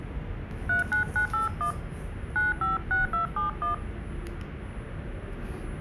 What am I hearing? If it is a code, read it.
DTMF, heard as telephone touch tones, dialled by hand, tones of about 130 ms, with the noise inside a lift. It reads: 39981 956271